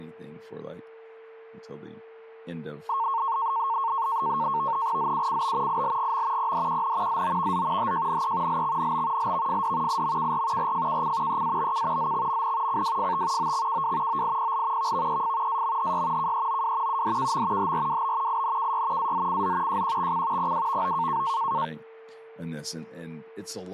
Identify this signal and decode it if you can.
NAVTEX (SITOR-B), 100 baud, 170 Hz shift, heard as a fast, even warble, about 1000 Hz centre, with a steady whistle near 450 Hz and speech in English. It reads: ZUCB ILGM PDQN ZOVZ HJNE LXNB LVFD IMKR RFKC EABK ZXMN CWFT OXKW OIPL VVEF AMHY KEOW UDKM HRWB INKY AZCZ JQXC PWVO